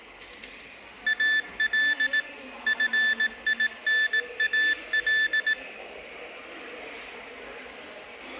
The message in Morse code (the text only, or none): AL FINAL